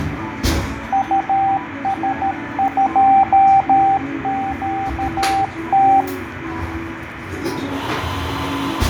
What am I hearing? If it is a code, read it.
Morse code, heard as a keyed tone, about 13 wpm, 780 Hz, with radio static, fading and the noise of a cafe. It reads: US2QT